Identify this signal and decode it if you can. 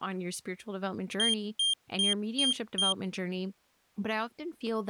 Beep code, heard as a piezo beeper, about 3200 Hz, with speech in English. 5 short. In AMI BIOS tables: processor failure; in Dell tables: CMOS battery failure.